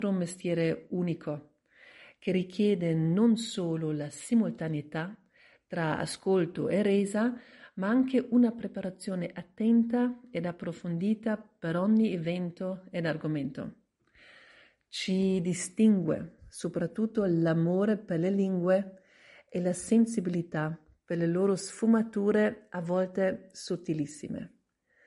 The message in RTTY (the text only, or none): none